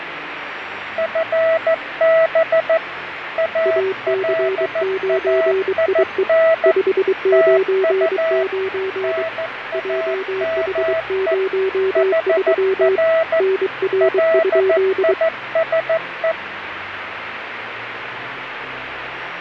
Morse code, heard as two keyed tones, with radio static and fading. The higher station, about 14 wpm, 650 Hz: FB ALAIN TU NAME HR LISE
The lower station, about 23 wpm, 380 Hz: AC9IE 599 JH03 NR?